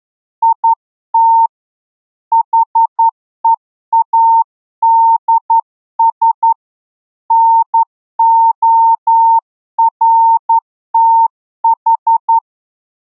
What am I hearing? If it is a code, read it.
Morse code, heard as a keyed tone, hand-sent with a straight key, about 11 wpm, 910 Hz. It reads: IT HEADS NORTH